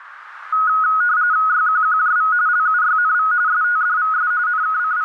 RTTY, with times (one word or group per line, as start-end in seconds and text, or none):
1.5-2.3 YQQJV
2.5-3.3 LUYNV
3.5-4.3 STDVS
4.5-5.0 …